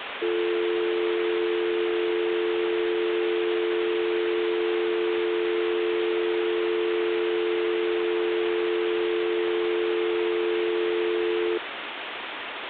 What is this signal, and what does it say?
Telephone call progress tone (North American or UK plan), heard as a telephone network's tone, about 350, 440 Hz, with phone line noise. Dial tone.